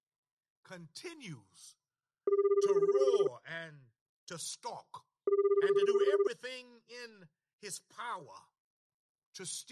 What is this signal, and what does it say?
Telephone call progress tone (Japanese plan), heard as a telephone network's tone, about 380, 400, 420 Hz, 1 s on and 2 s off, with speech in English. Ringback tone.